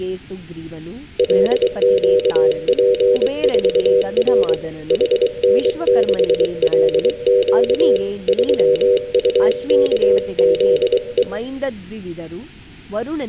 Morse code, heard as a keyed tone, hand-sent with a paddle, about 23 wpm, 490 Hz, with room echo and speech in Kannada. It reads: LQP4R HN6LQ 3UKZE